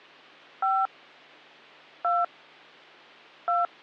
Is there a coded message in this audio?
Yes: DTMF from 0.6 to 3.7 s, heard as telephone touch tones, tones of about 190 ms. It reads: 5 2 2